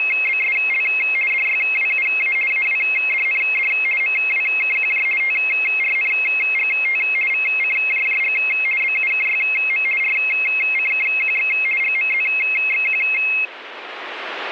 RTTY (50 baud, 450 Hz shift), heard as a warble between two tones, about 2350 Hz centre. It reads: … DYWUA AWDND MWKQJ TRNGT VCJJG BUKYM RCKQX GMZXQ